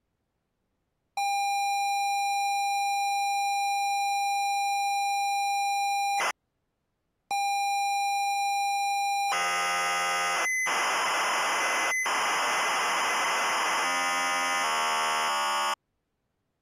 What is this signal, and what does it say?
ZX Spectrum tape loading, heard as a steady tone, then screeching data.